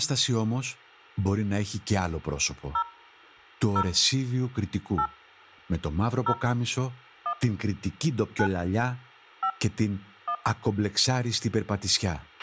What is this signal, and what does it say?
DTMF, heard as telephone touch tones, dialled by hand, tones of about 80 ms, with a squelch burst at the end and speech in Greek. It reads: 0 0 8 0 1 9 5 1